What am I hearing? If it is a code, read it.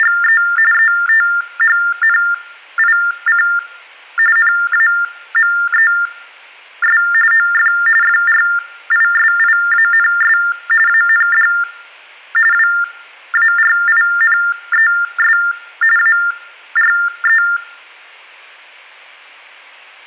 TTY/TDD text telephone tones (45.45 baud Baudot), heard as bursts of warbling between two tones, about 400 Hz shift, 1600 Hz centre, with room echo. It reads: … ETHNIC NAMES OF FRISIANS AND WARINES ARE